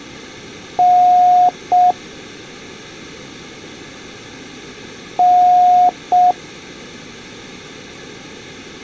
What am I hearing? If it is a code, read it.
Beep code, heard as beeps, played twice, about 720 Hz. 1 long, 1 short. In IBM BIOS tables: system board problem.